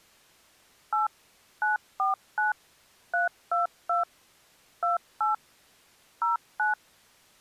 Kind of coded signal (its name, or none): DTMF